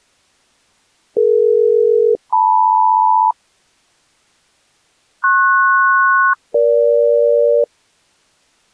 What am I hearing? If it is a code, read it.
Aircraft SELCAL, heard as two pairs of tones. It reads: DE-LM PS-EG